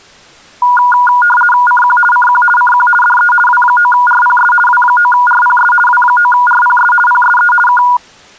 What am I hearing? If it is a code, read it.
RTTY (50 baud, 450 Hz shift), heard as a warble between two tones, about 1210 Hz centre. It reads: CQ CQ CQ DE W9RPS W9RPS W9RPS PSE K